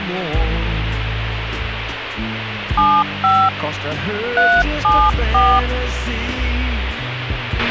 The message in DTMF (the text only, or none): 75 374